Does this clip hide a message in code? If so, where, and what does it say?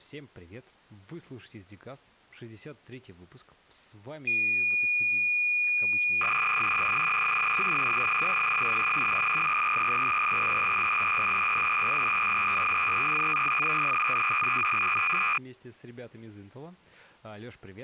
Yes: cassette data (Kansas City type), 300 baud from 4.3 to 15.4 s, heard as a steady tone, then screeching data, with speech in Russian.